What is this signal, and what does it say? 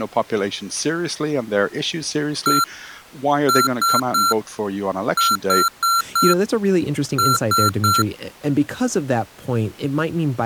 Beep code, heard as beeps from a small speaker, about 1360 Hz, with speech in English. 1-3-4-3. In Phoenix BIOS tables: memory failure on data bits.